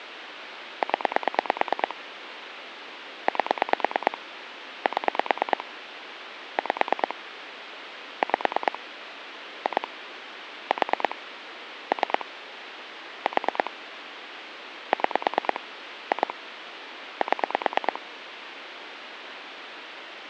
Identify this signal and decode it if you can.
Pulse dialling, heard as clicks on a phone line, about 9 pulses a second, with phone line noise. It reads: 0 8 7 5 5 2 4 3 4 6 2 7